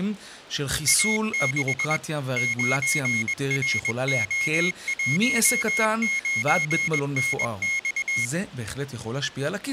Morse code, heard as a high beeper, machine-sent, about 21 wpm, 2150 Hz, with speech in Hebrew. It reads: A6 9RO19NX